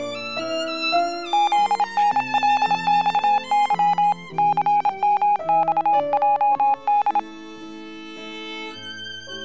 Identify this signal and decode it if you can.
Morse code (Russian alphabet), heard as a keyed tone, hand-sent with a paddle, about 27 wpm, 830 Hz. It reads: ЗНЛЬЫ ЦМЬЙД